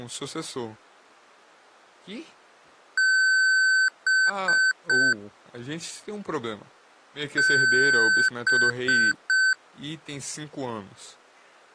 Beep code, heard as beeps from a small speaker, played twice, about 1550 Hz, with speech in Portuguese. 1 long, 3 short. In Award and IBM BIOS tables: video adapter failure; in AMI BIOS tables: memory failure.